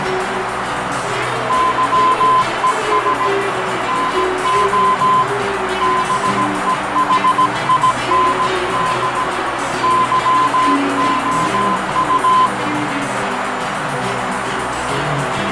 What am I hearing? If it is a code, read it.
Morse code, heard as a keyed tone, hand-sent with a paddle, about 17 wpm, 1020 Hz, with heavy radio static, fading and a narrow filter. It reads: YES NO BEHIND YOU